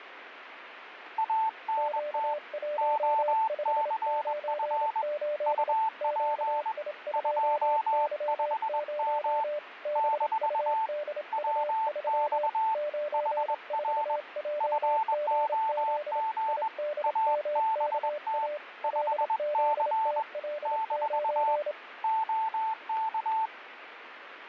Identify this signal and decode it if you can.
Morse code, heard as two keyed tones, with radio static. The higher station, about 21 wpm, 880 Hz: ANT OCF UP 25M - WX HR FOG ABT 5C - OK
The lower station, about 27 wpm, 590 Hz: Q1598 QI2Y0 BUDU3 94JGZ IDMKA LZTL9